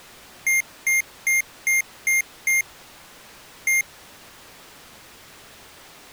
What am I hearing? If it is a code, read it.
Beep code, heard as beeps from a small speaker, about 2100 Hz. 6-1.